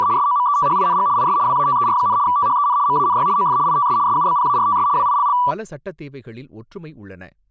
RTTY (75 baud, 170 Hz shift), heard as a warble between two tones, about 1070 Hz centre, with speech in Tamil. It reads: … SOMETHING IS WATER, THEN MANY OF ITS SUBPARTS WILL